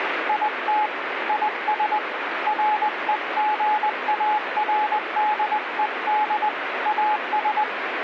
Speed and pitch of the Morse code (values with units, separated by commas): 20 wpm, 850 Hz